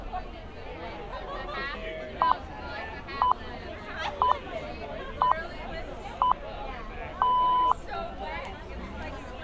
Radio time signal (six pips, as the Greenwich Time Signal), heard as pips, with street noise.